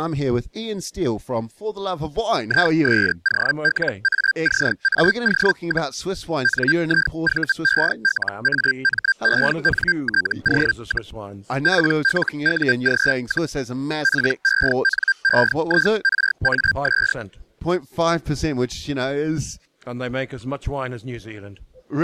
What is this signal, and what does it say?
Hellschreiber (Feld-Hell, 122.5 baud), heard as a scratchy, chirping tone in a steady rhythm, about 1600 Hz. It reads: ISOLACAO, NIVELAMENTO, PLUG, PENEIRAS